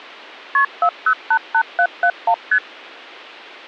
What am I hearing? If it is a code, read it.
Multi-frequency trunk signalling (R1, as on North American trunks), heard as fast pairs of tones, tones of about 70 ms. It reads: KP 4088771 ST